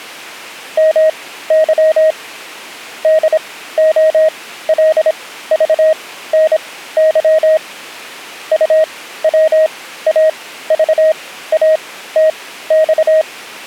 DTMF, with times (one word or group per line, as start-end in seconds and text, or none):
none